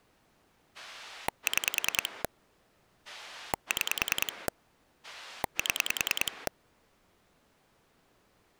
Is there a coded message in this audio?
Yes: pulse dialling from 0.7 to 6.5 s, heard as a rotary dial, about 10 pulses a second. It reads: 6 6 7